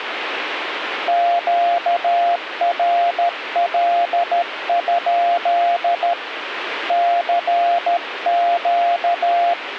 Morse code, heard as a keyed tone, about 13 wpm, 690 Hz, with radio static. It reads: QRL? CQ